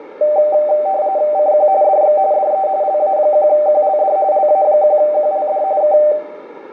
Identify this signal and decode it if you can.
RTTY (45.45 baud, 170 Hz shift), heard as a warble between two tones, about 690 Hz centre, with radio static. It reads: CQ DX DE LA1QLD LA1QLD K